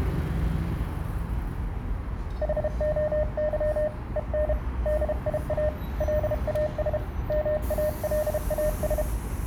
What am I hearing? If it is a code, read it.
Morse code, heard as a keyed tone, hand-sent with a paddle, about 32 wpm, 610 Hz, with the noise of a residential street. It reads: HOY EN DIA LAS MALAS